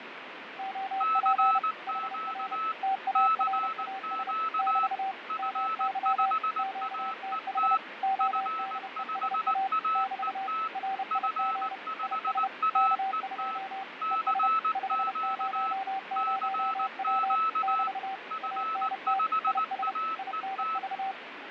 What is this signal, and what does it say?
Morse code, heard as two keyed tones, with radio static and fading. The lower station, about 30 wpm, 770 Hz: OP HR TARAS <BT> MY QTH ODESA <BT> RIG IS K2 ES 500W <BT> ANT IS INV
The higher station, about 19 wpm, 1310 Hz: CQ CQ F5AET F5AET F5AET CQ CQ F5AET